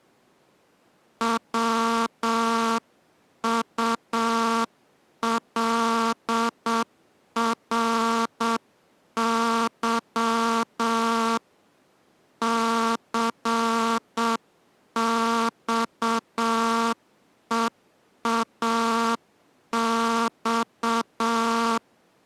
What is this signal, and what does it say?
Morse code, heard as a buzzer, hand-sent with a straight key, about 7 wpm. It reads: WULRY CXEAX